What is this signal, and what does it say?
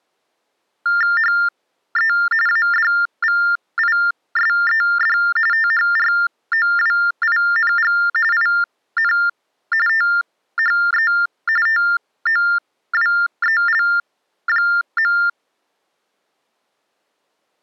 TTY/TDD text telephone tones (45.45 baud Baudot), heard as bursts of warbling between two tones, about 400 Hz shift, 1600 Hz centre. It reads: HE ADVISED THROWING IN THE TOWEL.